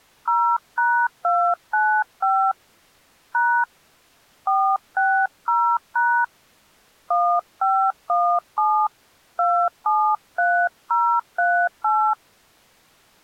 DTMF, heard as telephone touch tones, dialled by hand, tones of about 290 ms. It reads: 0#295 # 460# 1517 273038